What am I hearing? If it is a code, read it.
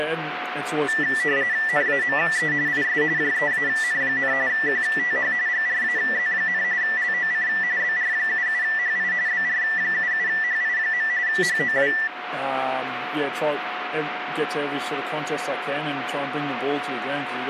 RTTY (45.45 baud, 170 Hz shift), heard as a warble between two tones, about 1850 Hz centre, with radio static and a steady whistle near 730 Hz. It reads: NAME IS JEAN, QTH GRAZ, LOC BR77HI BR77HI. HOW